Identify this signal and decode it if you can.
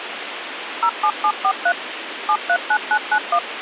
DTMF, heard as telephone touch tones, dialled by machine, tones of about 70 ms, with radio hiss. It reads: 07743 739991